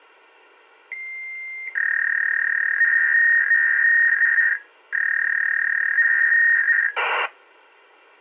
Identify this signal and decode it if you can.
Fax machine handshake, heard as a long tone and a warble.